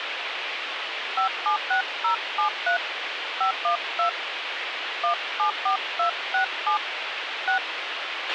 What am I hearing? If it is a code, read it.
DTMF, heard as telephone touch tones, dialled by hand, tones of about 110 ms, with radio hiss and a squelch burst at the end. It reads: 576073 512 174267 6